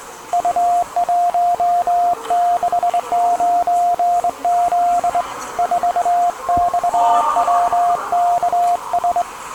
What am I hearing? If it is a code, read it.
Morse code, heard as a keyed tone, hand-sent with a straight key, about 22 wpm, 700 Hz, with the noise of a subway station. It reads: U169Z 4XWKS